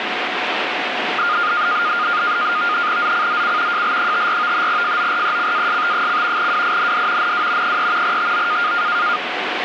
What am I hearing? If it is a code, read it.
NAVTEX (SITOR-B), 100 baud, 170 Hz shift, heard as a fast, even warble, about 1320 Hz centre, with radio static. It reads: ZCZC JL54 FORECAST: WIND NW 3 TO